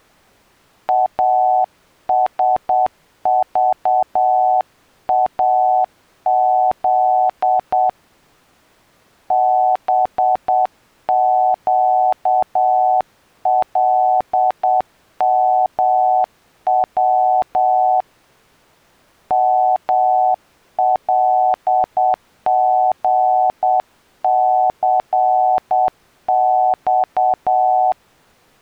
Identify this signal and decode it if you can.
Morse code, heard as a keyed tone, hand-sent with a paddle, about 8 wpm, 750 Hz. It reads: ASVAZ BQLMW MLGCX